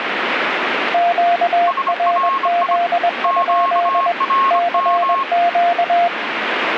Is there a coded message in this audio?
Yes: Morse code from 0.9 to 6.1 s, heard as two keyed tones, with radio static. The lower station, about 21 wpm, 700 Hz: QRZ? CQ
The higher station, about 25 wpm, 1080 Hz: SRI QRM